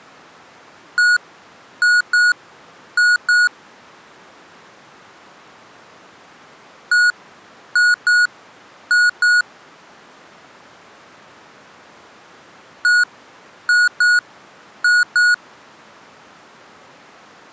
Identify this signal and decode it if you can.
Beep code, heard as beeps from a small speaker, played three times, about 1450 Hz. 1-2-2. In Phoenix BIOS tables: DMA initialisation failure.